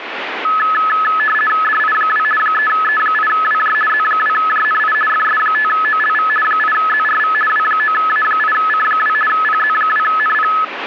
RTTY (50 baud, 450 Hz shift), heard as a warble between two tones, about 1500 Hz centre, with radio static. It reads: DI2 3E8WJ Z2JNI FS5OLV 8ZRV W9A8C2 PZ2NP